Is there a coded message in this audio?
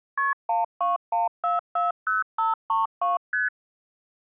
Yes: multi-frequency trunk signalling (R1, as on North American trunks) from 0.2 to 3.5 s, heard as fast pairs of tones, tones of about 160 ms. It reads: KP 121440532 ST